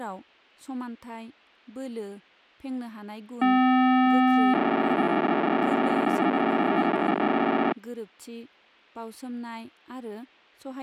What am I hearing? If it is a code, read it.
POCSAG pager data (512 baud), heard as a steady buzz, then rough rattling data, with speech in Bodo.